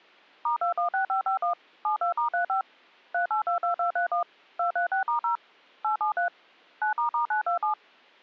DTMF, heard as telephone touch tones, dialled by machine, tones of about 110 ms. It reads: *216551 72*35 3822231 236*0 873 9**927